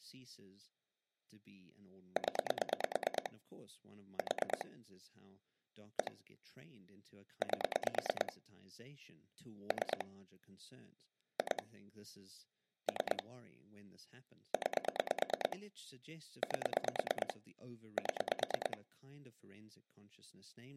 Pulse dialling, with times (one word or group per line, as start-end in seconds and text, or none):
2.2-3.3 0
4.2-4.6 4
6.0-6.1 1
7.4-8.3 8
9.7-10.0 3
11.4-11.6 2
12.9-13.2 3
14.5-15.6 9
16.4-17.3 8
18.0-18.8 7